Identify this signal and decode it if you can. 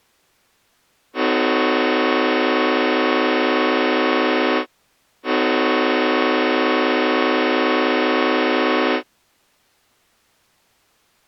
Train horn signal, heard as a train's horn. 2 long. On North American railways: brakes released, proceed.